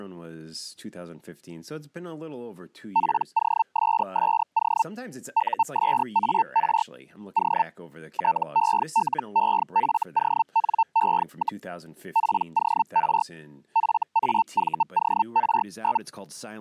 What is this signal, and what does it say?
Hellschreiber (Feld-Hell, 122.5 baud), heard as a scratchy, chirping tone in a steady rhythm, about 900 Hz, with speech in English. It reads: POSSO USAR O TELEFONE, POR FAVOR?